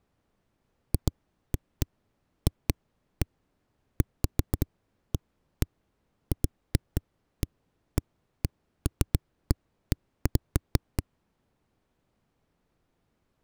Irregular knocks on a wall. There is no code.